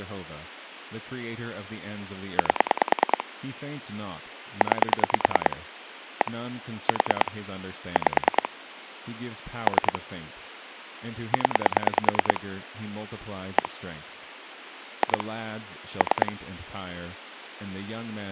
Pulse dialling, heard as clicks on a phone line, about 9 pulses a second, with speech in English. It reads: 8 9 1 4 5 3 0 1 2 3